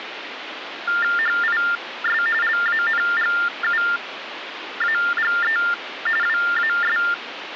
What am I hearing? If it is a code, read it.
TTY/TDD text telephone tones (45.45 baud Baudot), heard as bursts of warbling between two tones, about 400 Hz shift, 1600 Hz centre, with phone line noise. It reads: HIS LANGUAGE WAS